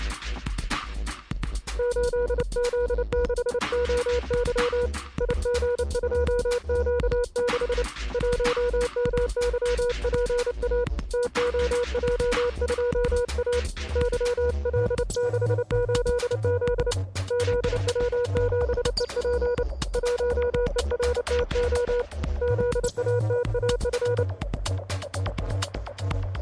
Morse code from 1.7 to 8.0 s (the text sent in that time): 8Z6OY IG2Q6